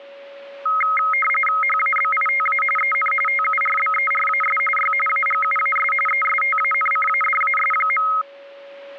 RTTY (45.45 baud, 850 Hz shift), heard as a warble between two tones, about 1700 Hz centre, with a steady whistle near 560 Hz. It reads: HABITA EN TURBERAS Y AGUAS ESTANCADAS.